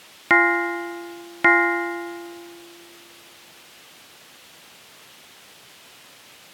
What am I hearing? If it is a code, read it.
Clock strike, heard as a bell. 2. Two o'clock.